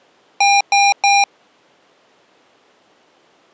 Beep code, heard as beeps from a small speaker, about 800 Hz. 3 short. In AMI BIOS tables: failure in the first 64 KB of memory; in Dell tables: chipset error.